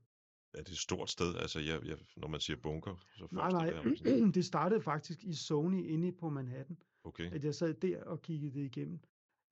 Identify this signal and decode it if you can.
Speech in Danish. There is no code.